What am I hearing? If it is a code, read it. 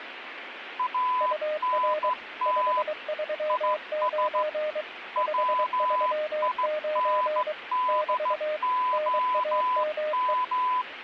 Morse code, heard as two keyed tones, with radio static. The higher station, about 15 wpm, 1000 Hz: ANT IS WINDOM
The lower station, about 23 wpm, 610 Hz: UR 539 539 <BT> NAME